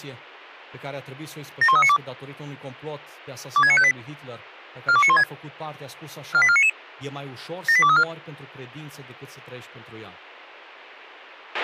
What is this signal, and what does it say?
Five-tone selective call (ZVEI), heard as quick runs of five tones, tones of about 70 ms, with a squelch burst at the end and speech in Romanian. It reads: 71392 26958 42916 48499 78234